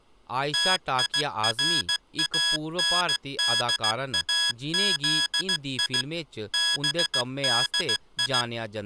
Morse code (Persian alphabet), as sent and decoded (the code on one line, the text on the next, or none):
- .. .-. .- -. -.. .- --.. .. / -... -.. ..
تیراندازی بدی